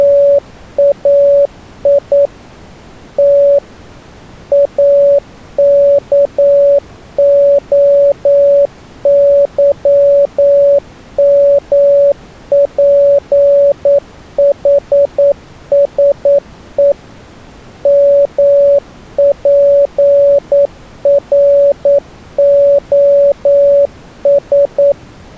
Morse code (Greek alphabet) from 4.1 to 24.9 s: ΑΚΟΥΜΠΗΣΕ ΜΠΡΟΣ

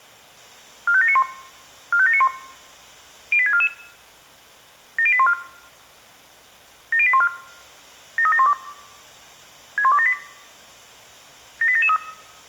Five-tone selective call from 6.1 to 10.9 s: 70814 73712 61278

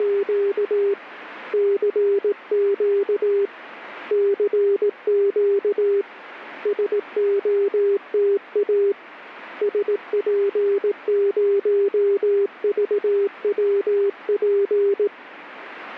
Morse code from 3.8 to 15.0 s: CQ SOTA SP0VWP

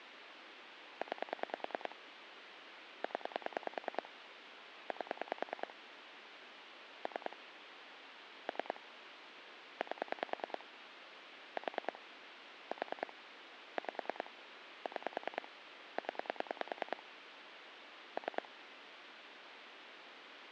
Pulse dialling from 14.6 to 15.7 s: 6

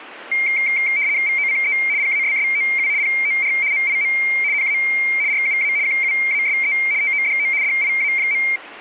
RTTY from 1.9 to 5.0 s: PASSOU POR MIM NA

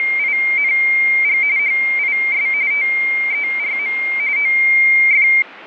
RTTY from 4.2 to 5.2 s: OF

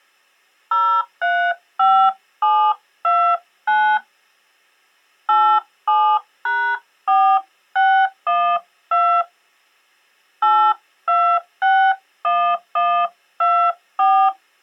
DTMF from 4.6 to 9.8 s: 87#4612

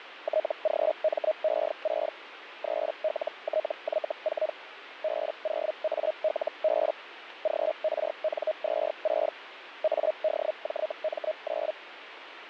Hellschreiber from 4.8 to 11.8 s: B0ALB GRN26 ADJM9

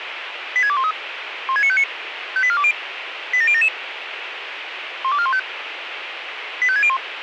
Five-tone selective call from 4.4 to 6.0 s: 12415

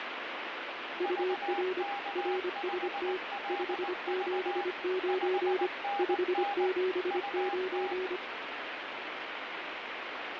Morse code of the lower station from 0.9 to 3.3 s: UR RST

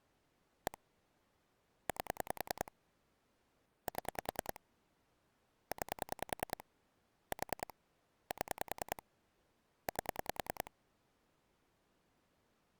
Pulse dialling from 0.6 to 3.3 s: 1 8

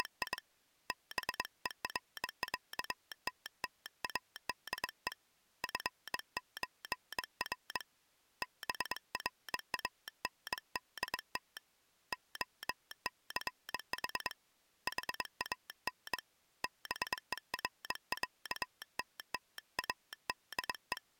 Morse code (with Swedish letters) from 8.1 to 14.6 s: BRANDT OCH

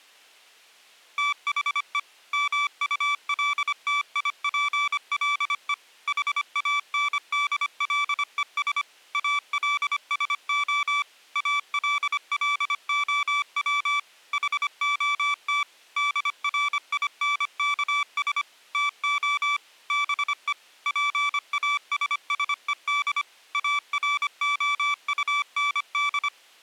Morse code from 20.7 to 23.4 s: PASSED

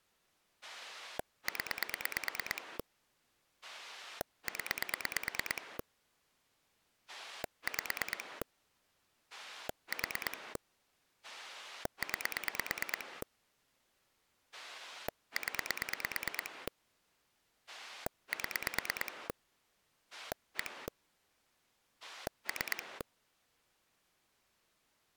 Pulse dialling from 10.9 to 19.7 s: 9 0 7

